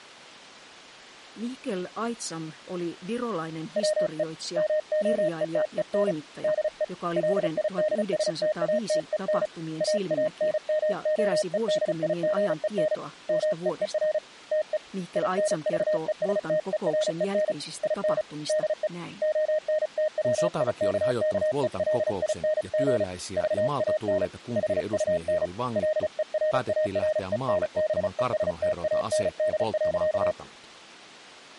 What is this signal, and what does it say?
Morse code, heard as a keyed tone, hand-sent with a paddle, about 35 wpm, 620 Hz, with speech in Finnish. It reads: WE MOETEN DE LIDSTATEN AANMOEDIGEN MEER TE INVESTEREN IN DE ONTWIKKELING VAN HUN LERARENBESTAND.